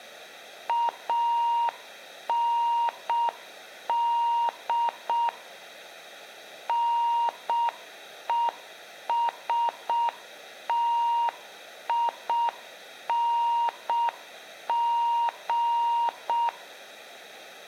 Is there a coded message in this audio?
Yes: Morse code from 0.6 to 16.5 s, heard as a keyed tone, machine-sent, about 6 wpm, 940 Hz, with room echo. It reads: AND NESTING